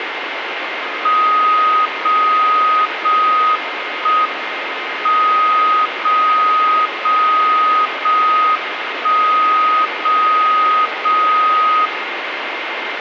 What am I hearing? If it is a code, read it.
Radio time signal (JJY), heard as a tone whose level steps once a second, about 1250 Hz, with radio static and a steady whistle near 2110 Hz. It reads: 0 0 1 M 0 0 0 1 0 0 0